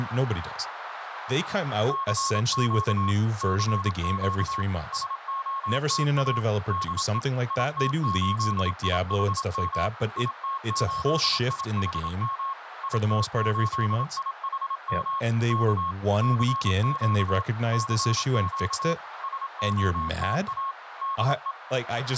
Morse code, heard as a keyed tone, machine-sent, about 27 wpm, 1090 Hz, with radio static, a narrow filter and speech in English. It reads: CQ CQ SOTA DE IT8IHM IT8IHM IT8IHM K CQ CQ SOTA DE